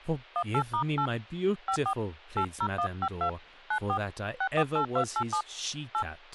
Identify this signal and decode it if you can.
DTMF, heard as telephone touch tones, dialled by hand, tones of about 80 ms, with speech in English. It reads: 18*8 54 80152 94 648287 8